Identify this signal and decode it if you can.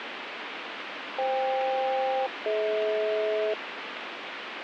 Aircraft SELCAL, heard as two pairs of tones, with radio static. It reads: FK-DH